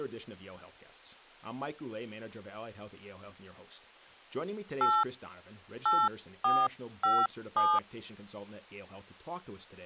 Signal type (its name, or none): DTMF